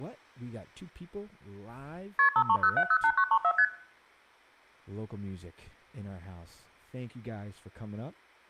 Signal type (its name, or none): multi-frequency trunk signalling